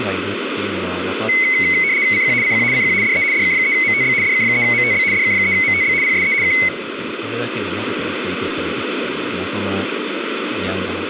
RTTY (75 baud, 170 Hz shift), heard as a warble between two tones, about 2150 Hz centre, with radio static and speech in Japanese. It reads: CQ CQ CQ DE DK3MTB DK3MTB DK3MTB PSE K